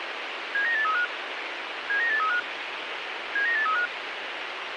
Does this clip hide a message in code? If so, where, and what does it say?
Yes: five-tone selective call (CCIR) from 0.5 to 3.9 s, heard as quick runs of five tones, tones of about 100 ms, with radio hiss. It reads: 79835 79835 79835